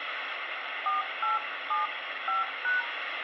DTMF, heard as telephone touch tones, dialled by hand, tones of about 150 ms, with phone line noise and room echo. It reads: 4875#